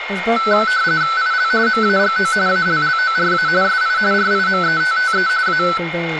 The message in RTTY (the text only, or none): IL MAGO ALLORA SI RIMETTE A